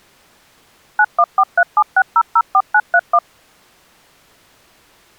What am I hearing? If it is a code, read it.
DTMF, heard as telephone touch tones, dialled by machine, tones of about 60 ms. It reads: 914376004931